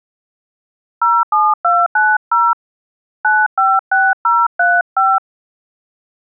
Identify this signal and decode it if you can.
DTMF, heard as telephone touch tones, dialled by hand, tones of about 220 ms. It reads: 07290 956035